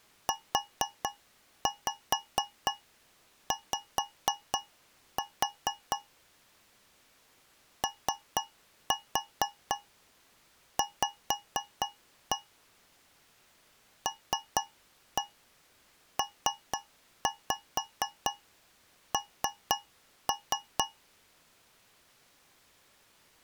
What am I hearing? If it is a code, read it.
Tap code, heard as taps on a metal pipe, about 4 knocks a second. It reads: UY OV LPN